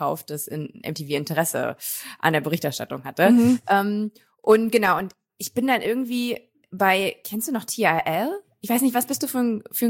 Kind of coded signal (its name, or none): none